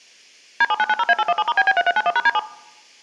DTMF, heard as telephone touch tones, dialled by machine, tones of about 40 ms. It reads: D7990A817*BB3391#D7